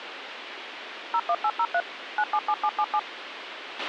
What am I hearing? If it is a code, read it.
DTMF, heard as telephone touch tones, dialled by machine, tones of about 60 ms, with radio hiss and a squelch burst at the end. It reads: 01803 977777